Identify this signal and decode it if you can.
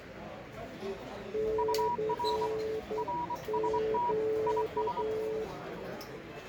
Morse code, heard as two keyed tones, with the noise of a cafe. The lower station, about 10 wpm, 440 Hz: CQ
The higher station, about 24 wpm, 960 Hz: UR RST IS